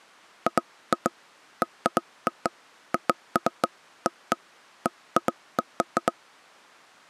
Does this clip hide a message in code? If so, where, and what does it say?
No, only irregular taps on a table.